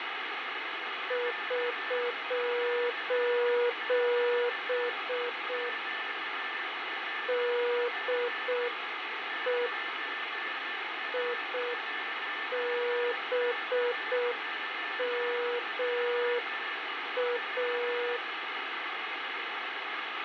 Morse code, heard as a keyed tone, hand-sent with a paddle, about 6 wpm, 480 Hz, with radio static, fading and a weaker station near 1770 Hz. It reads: <SOS> DE IBMA